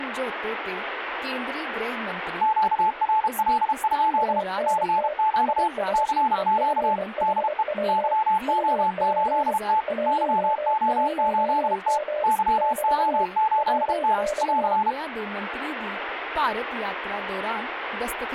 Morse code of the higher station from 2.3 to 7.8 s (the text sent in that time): QRL? CQ CQ DE